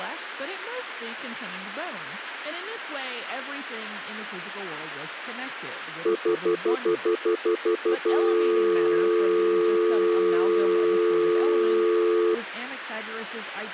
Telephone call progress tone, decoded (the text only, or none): stutter dial tone